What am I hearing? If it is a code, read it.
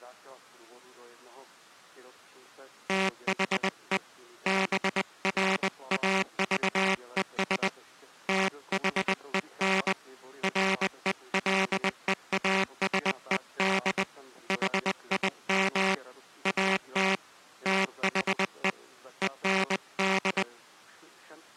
Morse code, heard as a buzzer, hand-sent with a paddle, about 20 wpm. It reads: THE BRAVES THEN RELEASED HIM AT THE END